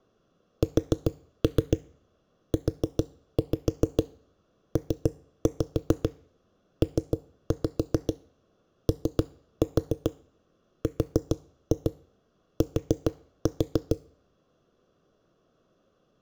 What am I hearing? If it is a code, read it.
Tap code, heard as knocks on a wall, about 7 knocks a second. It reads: SUPPORT